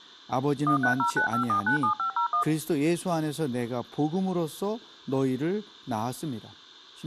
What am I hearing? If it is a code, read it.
DTMF, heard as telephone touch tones, dialled by machine, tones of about 100 ms, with speech in Korean. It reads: 13095497501